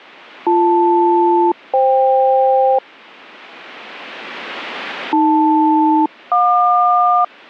Aircraft SELCAL, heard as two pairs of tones. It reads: BL-FK AL-JQ